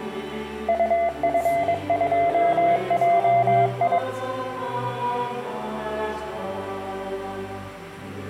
Morse code, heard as a keyed tone, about 22 wpm, 690 Hz. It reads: UF2JI